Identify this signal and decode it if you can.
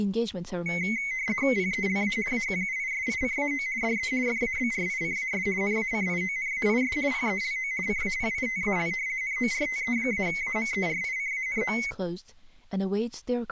RTTY (50 baud, 170 Hz shift), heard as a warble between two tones, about 2150 Hz centre, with speech in English. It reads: PELA AQUISICAO DE FABRICAS NACIONAIS PELO CAPITAL NORTE-AMERICANO